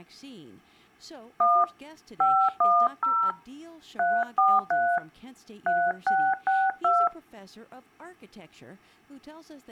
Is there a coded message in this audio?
Yes: DTMF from 1.4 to 7.1 s, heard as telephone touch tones, dialled by hand, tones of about 240 ms, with speech in English. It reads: 1 510 343 3662